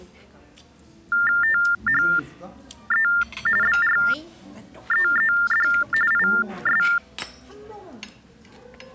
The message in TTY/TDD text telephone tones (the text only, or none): THE BREED IS